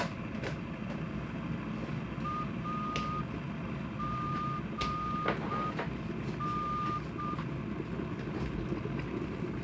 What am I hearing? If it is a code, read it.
Morse code, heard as a whistle, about 6 wpm, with kitchen noise. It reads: AGN